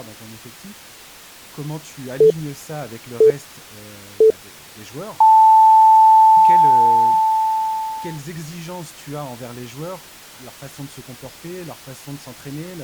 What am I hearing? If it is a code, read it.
Radio time signal (three low pips and a long one an octave up, as on NHK), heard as pips, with speech in French.